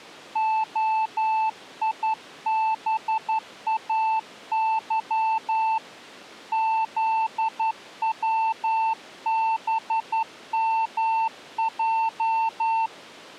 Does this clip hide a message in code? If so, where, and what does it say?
Yes: Morse code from 0.3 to 12.9 s, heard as a keyed tone, hand-sent with a straight key, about 11 wpm, 890 Hz. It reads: OIBAY ZWBMJ